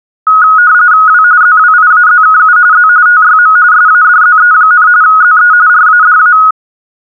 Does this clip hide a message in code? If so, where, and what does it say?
Yes: RTTY (45.45 baud, 170 Hz shift) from 0.3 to 6.5 s, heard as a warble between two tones, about 1360 Hz centre. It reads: W ZWIAZKU Z TYM SADZE, ZE RADA